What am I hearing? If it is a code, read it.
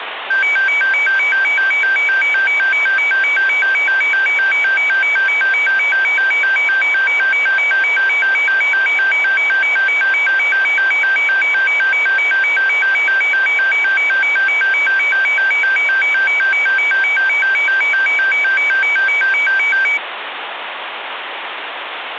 A tone that alternates evenly between two pitches, with phone line noise. There is no code.